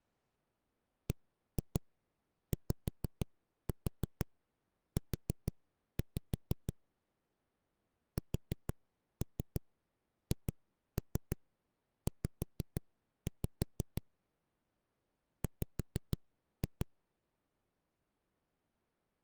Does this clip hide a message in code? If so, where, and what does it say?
Yes: tap code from 1.1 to 16.8 s, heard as knocks on a wall, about 6 knocks a second. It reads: BYU SHZ W